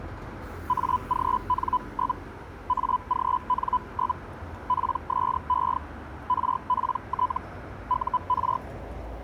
Hellschreiber (Feld-Hell, 122.5 baud), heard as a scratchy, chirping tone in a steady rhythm, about 1000 Hz, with street noise. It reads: AGN? AGN? PSE RPT UR